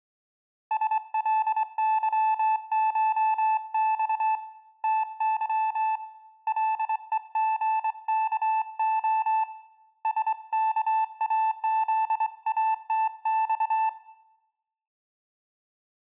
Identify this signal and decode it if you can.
Morse code (Russian alphabet), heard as a keyed tone, hand-sent with a straight key, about 23 wpm, 880 Hz, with room echo. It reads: СЛЫШЬ ТЫ ЛЕГКО СКАЗАТЬ